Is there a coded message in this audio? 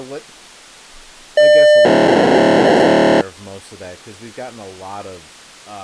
Yes: POCSAG pager data (1200 baud) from 1.4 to 3.2 s, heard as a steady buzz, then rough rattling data, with speech in English.